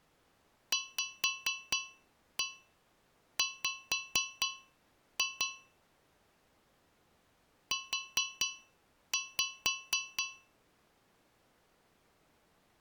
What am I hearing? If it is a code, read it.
Tap code, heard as taps on a metal pipe, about 4 knocks a second. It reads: VW U